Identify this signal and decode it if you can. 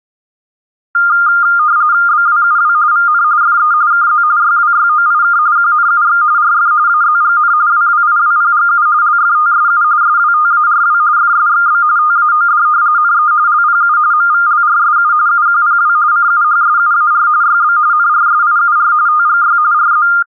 RTTY (45.45 baud, 170 Hz shift), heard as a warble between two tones, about 1310 Hz centre. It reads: BWUW VN FE KZ YWYOIK QNUX RF AZGN WWIWPGU LFTSU SWTARW FSXB TAOD NE LPU MVLRSU UQPW CUHSUAR YB NRSIUR TGY RZ